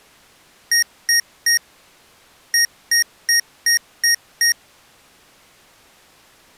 Beep code, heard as beeps from a small speaker, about 1850 Hz. 3-6.